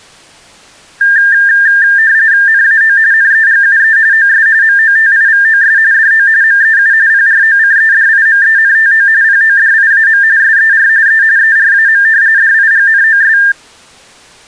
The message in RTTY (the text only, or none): NAO NEGUE OS MOTIVOS DO MEU PROCEDIMENTO PODIAM SER E ERAM DIGNOS